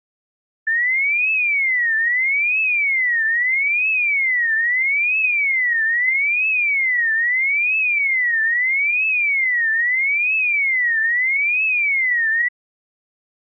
A tone that sweeps in pitch again and again. There is no code.